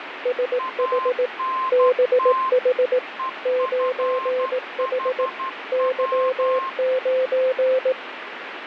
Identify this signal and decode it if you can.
Morse code, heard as two keyed tones, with radio static. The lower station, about 18 wpm, 510 Hz: SH BH 9H Y9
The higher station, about 12 wpm, 1050 Hz: ANT EFHW